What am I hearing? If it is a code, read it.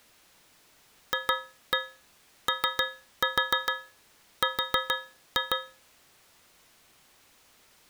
Tap code, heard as taps on a metal pipe, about 6 knocks a second. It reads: FOR